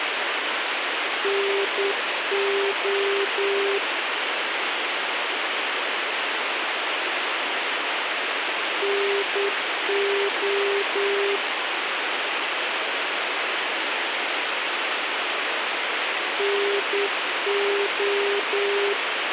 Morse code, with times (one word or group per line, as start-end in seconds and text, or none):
1.2-3.8 NO
8.8-11.4 NO
16.4-18.9 NO